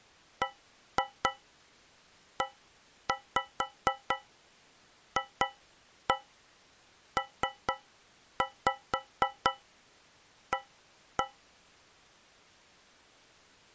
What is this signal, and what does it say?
Tap code, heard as taps on a metal pipe, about 4 knocks a second. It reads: BEFPA